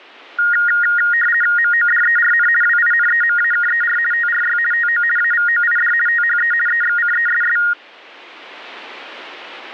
RTTY (50 baud, 450 Hz shift), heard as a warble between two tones, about 1650 Hz centre. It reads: MODERN WINEMAKER TRY TO AVOID THE EXCESS